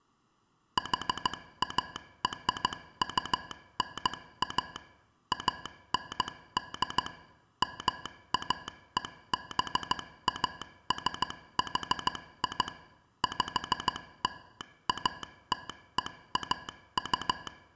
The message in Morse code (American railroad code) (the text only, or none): HARUNA AND MAEBASHI …